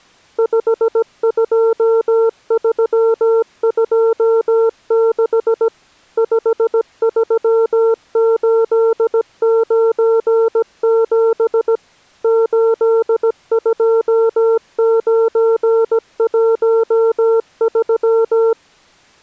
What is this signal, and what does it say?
Morse code, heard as a keyed tone, machine-sent, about 17 wpm, 450 Hz. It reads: 52326 53897 82913